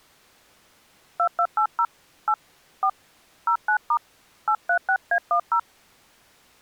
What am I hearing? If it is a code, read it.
DTMF, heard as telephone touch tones, dialled by hand, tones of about 80 ms. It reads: 2280 8 4 09* 836A10